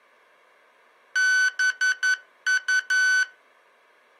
Morse code, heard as electronic beeps, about 11 wpm, 1500 Hz. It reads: BU